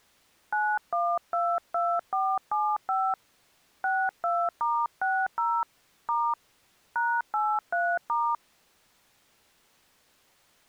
DTMF, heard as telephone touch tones, dialled by hand, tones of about 250 ms. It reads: 9122475 62*60 * #83*